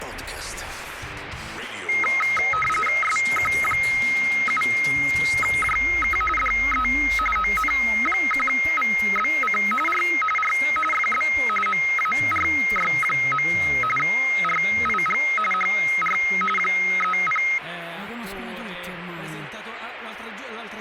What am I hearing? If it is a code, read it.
RTTY (45.45 baud, 850 Hz shift), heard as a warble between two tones, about 1700 Hz centre, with radio static. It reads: SQ7JK DE ON1VBC R R FB MARY. RIG HR 30